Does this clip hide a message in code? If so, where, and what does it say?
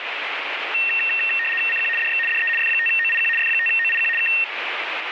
Yes: RTTY (75 baud, 850 Hz shift) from 0.7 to 4.4 s, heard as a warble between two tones, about 2250 Hz centre, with radio static. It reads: CQ DX DE F5OIQ F5OIQ K